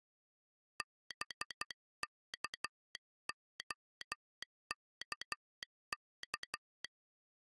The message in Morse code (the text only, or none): BKOKK